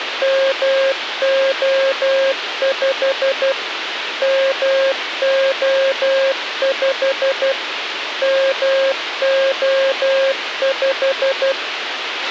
Morse code, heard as a keyed tone, machine-sent, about 12 wpm, 540 Hz, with radio hiss and a squelch burst at the end. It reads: MO5 MO5 MO5